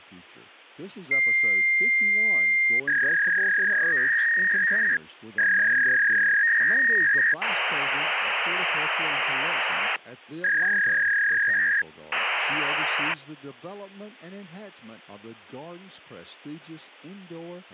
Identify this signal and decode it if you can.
Fax machine handshake, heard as a long tone, a warble and hiss, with speech in English.